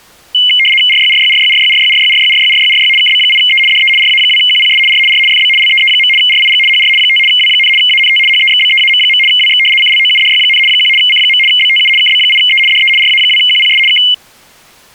RTTY (75 baud, 850 Hz shift), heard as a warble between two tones, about 2550 Hz centre. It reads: RYRYRYRYRYRYRYRYRYRY KB8E DE RA2QPS R R FB LEE. RIG HR 5 W, ANT HEXBEAM. WX CLOUDY, 1 C. BTU KB8E DE RA2QPS K